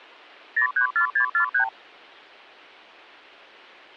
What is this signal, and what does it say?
Multi-frequency trunk signalling (R2, with the far end's replies), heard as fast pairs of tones, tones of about 100 ms. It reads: 034643